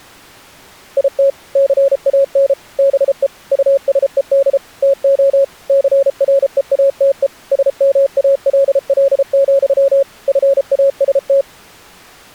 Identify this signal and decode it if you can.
Morse code, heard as a keyed tone, machine-sent, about 33 wpm, 550 Hz. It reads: IT CAN BE USED TO CREATE SMALL, FAST